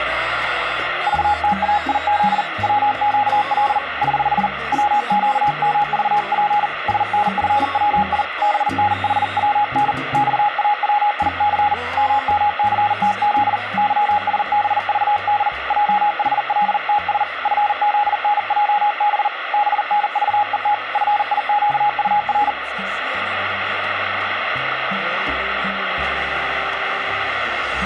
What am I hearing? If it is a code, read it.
Morse code, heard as a keyed tone, hand-sent with a paddle, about 40 wpm, 830 Hz, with radio static. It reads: VTAIZ WQL <HH> WQMVP SNFWI BNHWN XAWIC MMCTZ YSBVD JHLTS FZNJB BNVET FIQUR